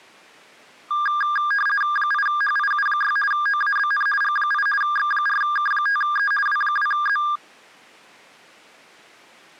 RTTY (50 baud, 450 Hz shift), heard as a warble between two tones, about 1410 Hz centre. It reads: 8HIU6 OABN G8 X4K5E W2Z